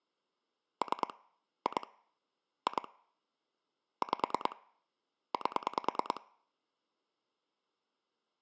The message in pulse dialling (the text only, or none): 3 2 2 5 8